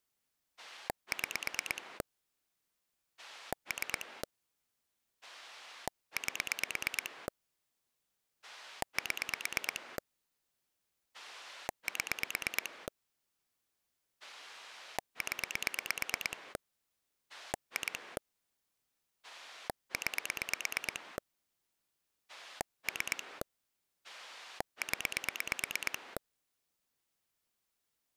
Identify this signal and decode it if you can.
Pulse dialling, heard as a rotary dial, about 8 pulses a second. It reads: 6 3 8 7 7 0 2 9 3 0